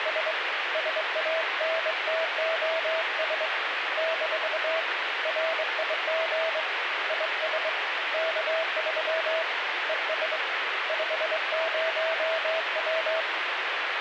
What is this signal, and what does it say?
Morse code, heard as a keyed tone, hand-sent with a straight key, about 23 wpm, 650 Hz, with radio static. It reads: … SANTOS - RIG IS K3 ES 50W